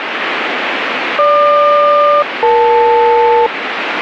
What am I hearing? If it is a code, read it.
Aircraft SELCAL, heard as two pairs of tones, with radio static. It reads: GQ-EL